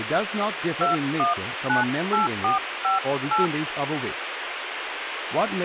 DTMF, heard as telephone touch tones, dialled by hand, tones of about 140 ms, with radio hiss and speech in English. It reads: 2198458